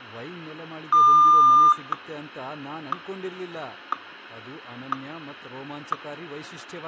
Radio time signal (WWVH, Hawaii), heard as ticks, one a second, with room echo and speech in Kannada.